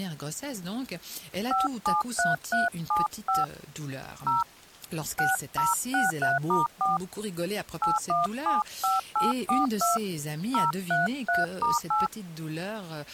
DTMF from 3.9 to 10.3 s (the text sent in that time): 0 6063*4 8175842